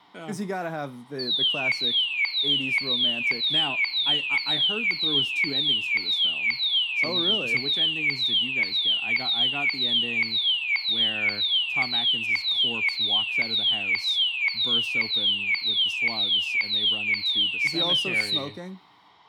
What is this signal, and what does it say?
A tone that sweeps in pitch again and again, with room echo and speech in English. There is no code.